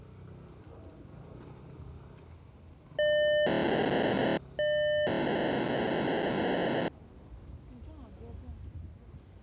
POCSAG pager data (1200 baud), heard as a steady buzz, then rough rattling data, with the noise of a residential street.